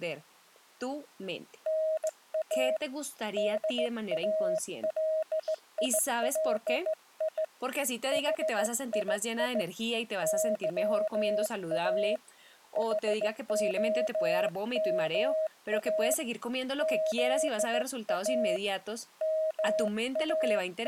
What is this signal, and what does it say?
Morse code, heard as a keyed tone, hand-sent with a straight key, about 16 wpm, 630 Hz, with speech in Spanish. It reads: NA DALILI HII YA HOMA ZA …